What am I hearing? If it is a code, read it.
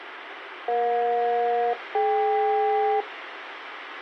Aircraft SELCAL, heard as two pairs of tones, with radio hiss and a squelch burst at the end. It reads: EJ-DK